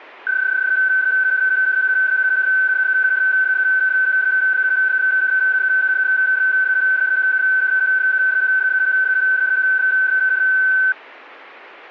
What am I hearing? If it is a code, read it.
PSK31 (31.25 baud), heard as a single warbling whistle, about 1550 Hz.